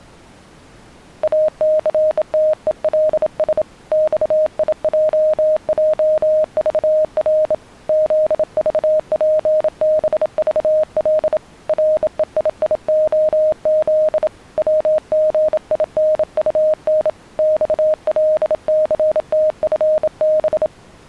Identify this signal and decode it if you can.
Morse code, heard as a keyed tone, hand-sent with a bug key, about 27 wpm, 620 Hz. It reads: ACTELS XIJJVR ZVPBVL REIIOZ WGINUN XLCTFB